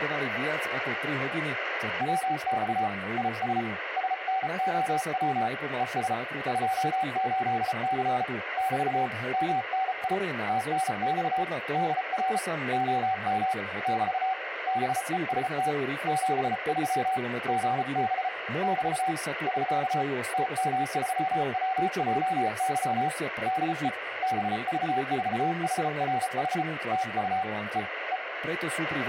Morse code, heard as a keyed tone, hand-sent with a paddle, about 34 wpm, 760 Hz, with radio static and speech in Slovak. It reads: WX IS SNOW ES 28C <BT> MNI TNX DR OM <BT> BEST 73 GB <BT> <SK> TM3WJY DE BV4HRH TU E E